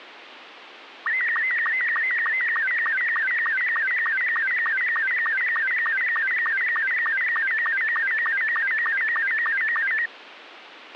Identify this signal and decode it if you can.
SSTV (slow-scan television), Robot 72, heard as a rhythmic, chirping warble, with radio hiss and a squelch burst at the end.